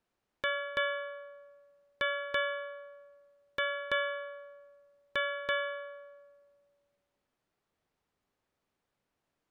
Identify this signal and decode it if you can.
Ship's bell, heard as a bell. 8. Eight half-hours of the watch have passed.